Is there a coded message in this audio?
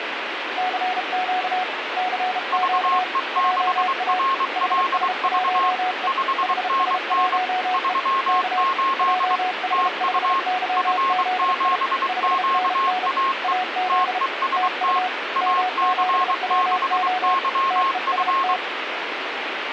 Yes: Morse code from 0.5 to 18.6 s, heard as two keyed tones, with radio static. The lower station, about 33 wpm, 740 Hz: CQ CQ JA HS1E HS1E K JH5YZI 5NN AZ TU M7WO TEST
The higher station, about 23 wpm, 1080 Hz: VE6RLV 5NN 38 TU F7QAE TEST AC6YF